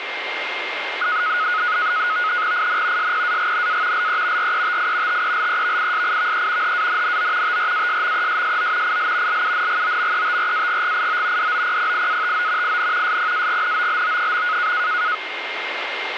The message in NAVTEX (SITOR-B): IN SPAGNA LE RETI TELEVISIVE HANNO TRASMESSO IL LUNGOMETRAGGIO DOPPIATO IN SPAGNOLO.

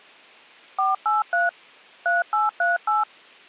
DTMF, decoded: 483 3838

